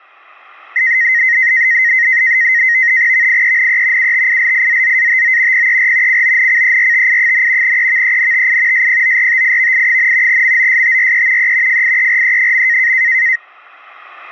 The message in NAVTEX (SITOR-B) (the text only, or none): VIENE UTILIZZATO PER CONCERTI, EVENTI SPORTIVI, MOSTRE E FIERE.